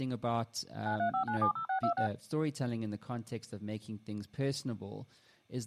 DTMF, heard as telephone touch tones, dialled by machine, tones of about 100 ms, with speech in English. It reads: 935970626